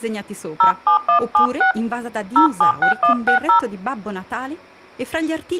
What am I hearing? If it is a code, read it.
DTMF, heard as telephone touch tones, dialled by hand, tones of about 110 ms. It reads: 07176 076160